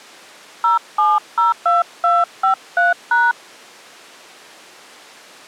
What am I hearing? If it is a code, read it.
DTMF, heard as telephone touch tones, dialled by hand, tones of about 160 ms. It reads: 0702253#